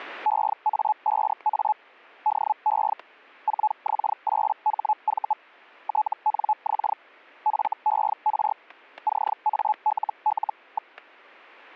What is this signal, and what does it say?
Hellschreiber (Feld-Hell, 122.5 baud), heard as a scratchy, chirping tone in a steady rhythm, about 860 Hz, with static crashes. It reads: EA5A DE 4X8HV TNX FER CALL.